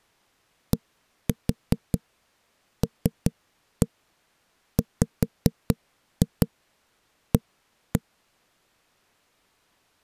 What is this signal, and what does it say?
Tap code, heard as knocks on a wall, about 5 knocks a second. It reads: DLWA